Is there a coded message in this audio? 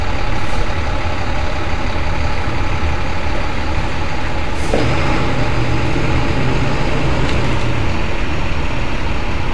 No, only street noise.